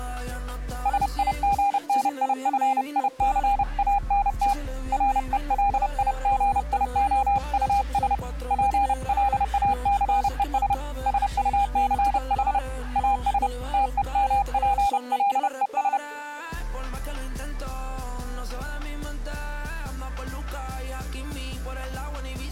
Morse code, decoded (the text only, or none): SIGNIFICANT RELIGIOUS PLACES SUCH AS TEMPLES